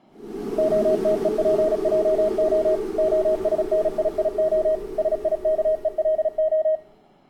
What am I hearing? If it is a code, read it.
Morse code (Hebrew alphabet), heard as a keyed tone, machine-sent, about 36 wpm, 630 Hz, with room echo. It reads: התופעה השנייה שיכולה